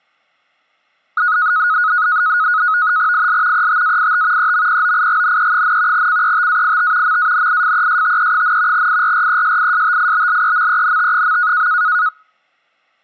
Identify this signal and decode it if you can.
NAVTEX (SITOR-B), 100 baud, 170 Hz shift, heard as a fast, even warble, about 1360 Hz centre. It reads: IL ETAIT EMPOIGNE, CETAIT MANIFESTE, IRRESISTIBLEMENT.